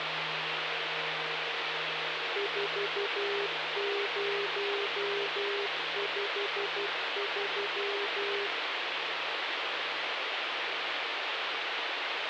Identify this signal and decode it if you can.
Morse code, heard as a keyed tone, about 12 wpm, 400 Hz, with heavy radio static. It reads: 4053